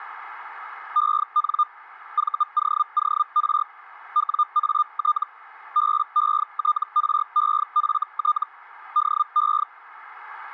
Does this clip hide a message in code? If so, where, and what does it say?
Yes: Hellschreiber (Feld-Hell, 122.5 baud) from 1.0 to 9.6 s, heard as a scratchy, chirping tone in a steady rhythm, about 1210 Hz. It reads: EN VOOR WAT BETREFT DE